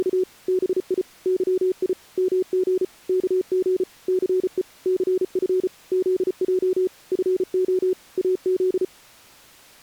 Morse code, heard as a keyed tone, machine-sent, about 34 wpm, 370 Hz. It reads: … BI YI MG KG CE CF ZJ FO AZ